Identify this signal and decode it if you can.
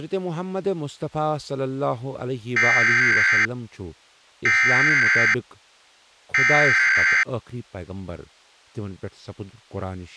Emergency Alert System (SAME) tones (header bursts), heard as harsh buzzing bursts, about 520.83 baud, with speech in Kashmiri.